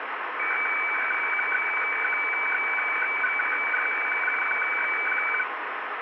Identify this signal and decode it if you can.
Weather fax (radiofax), 120 lines a minute, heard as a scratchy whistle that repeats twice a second, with radio static.